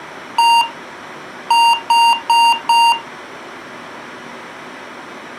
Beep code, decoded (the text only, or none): 1-4